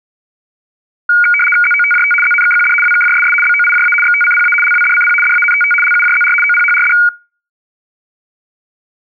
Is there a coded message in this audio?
Yes: RTTY (75 baud, 850 Hz shift) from 1.1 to 7.1 s, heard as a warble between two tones, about 1850 Hz centre. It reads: ZOTJT ZNKQD WKJSS BOIJA XTCPA LWDCP DANTT LUJZR OPHRD